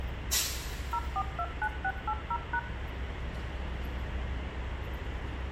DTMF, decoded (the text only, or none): 0429680#